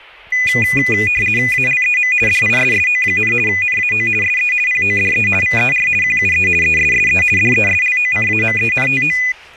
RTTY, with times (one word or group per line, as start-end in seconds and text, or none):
1.5-2.1 ALEM
2.3-3.3 DISSO,
3.5-4.1 NAO
4.2-4.5 SE
4.7-5.3 PODE
5.4-5.9 VER
6.0-6.5 QUE
6.6-7.2 ESSE
7.4-9.2 DESLOCAMENTO